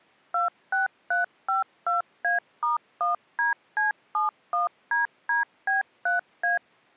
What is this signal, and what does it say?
DTMF, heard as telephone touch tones, dialled by machine, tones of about 140 ms. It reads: 26352A*1DC71DDB3A